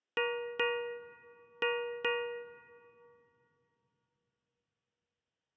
Ship's bell, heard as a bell. 4. Four half-hours of the watch have passed.